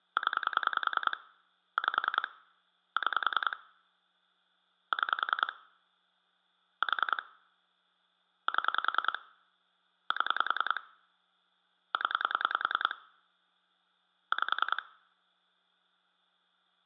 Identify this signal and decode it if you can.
Pulse dialling, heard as clicks on a phone line, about 10 pulses a second, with hum. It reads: 0 5 6 6 4 7 7 0 5